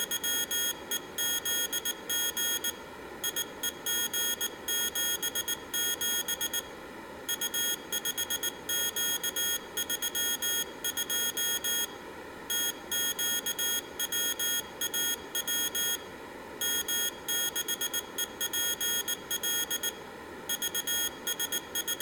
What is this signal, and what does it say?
Morse code, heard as a high beeper, hand-sent with a paddle, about 19 wpm, 3300 Hz, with room echo. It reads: … IEG77 U5Q32 TQWAW M6EPL …